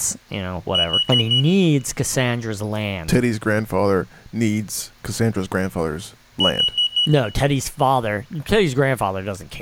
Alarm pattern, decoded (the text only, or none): temporal four